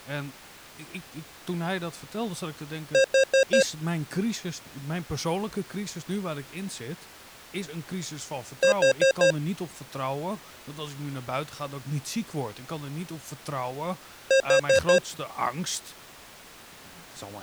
Alarm pattern, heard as an alarm's beeps, played three times, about 540 Hz, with speech in Dutch. Temporal four. Carbon monoxide.